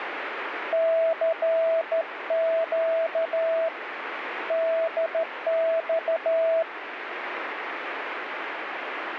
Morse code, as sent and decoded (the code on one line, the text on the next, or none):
-.-. --.- / -.. -..-
CQ DX